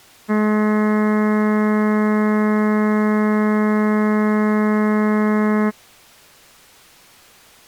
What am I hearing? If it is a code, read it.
Ship horn signal, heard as a ship's horn, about 210 Hz. 1 long. At sea: a vessel nearing a blind bend, or under power and making way in fog.